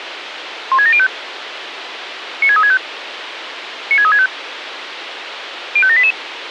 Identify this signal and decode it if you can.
Five-tone selective call (ZVEI), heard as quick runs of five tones, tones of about 70 ms, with radio hiss. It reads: 16705 96365 96365 05788